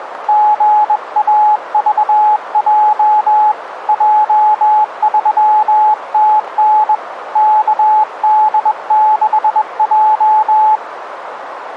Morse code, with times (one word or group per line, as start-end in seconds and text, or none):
0.3-3.5 GAVJ
3.9-6.9 J3TN
7.4-10.8 KD6J